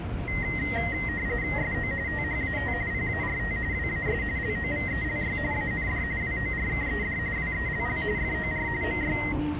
RTTY (45.45 baud, 170 Hz shift), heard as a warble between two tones, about 1950 Hz centre, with the noise inside a subway train. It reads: SO THAT PART WAS LOVELY AND WORKED WELL FOR MY